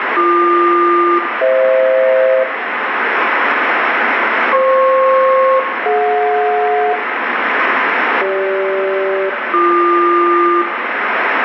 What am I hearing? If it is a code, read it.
Aircraft SELCAL, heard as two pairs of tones, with radio static and room echo. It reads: BQ-FH FP-DJ CG-BQ